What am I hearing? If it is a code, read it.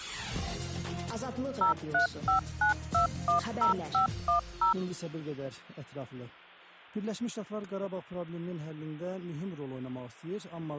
DTMF, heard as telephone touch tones, dialled by machine, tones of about 120 ms, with hum. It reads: 0359210510